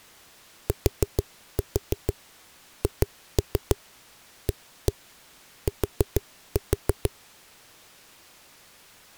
Tap code, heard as knocks on a wall, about 6 knocks a second. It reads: THAT